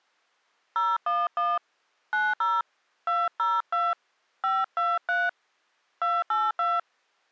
DTMF, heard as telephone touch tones, dialled by hand, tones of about 210 ms. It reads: 011 90 202 523 282